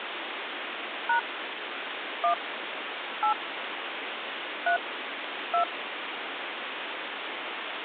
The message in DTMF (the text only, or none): # 1 8 3 2